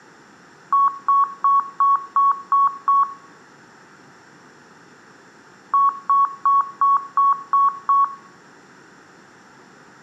Beep code, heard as beeps, played twice, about 1110 Hz, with room echo. 7 short. In AMI BIOS tables: virtual mode exception error; in Dell tables: processor failure.